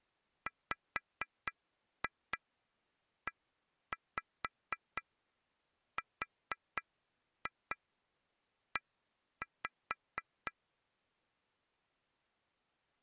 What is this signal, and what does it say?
Tap code, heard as taps on glass, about 4 knocks a second. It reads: WERE